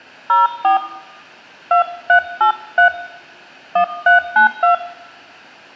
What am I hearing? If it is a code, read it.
DTMF, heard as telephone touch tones, dialled by hand, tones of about 130 ms, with room echo. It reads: 04 2383 1392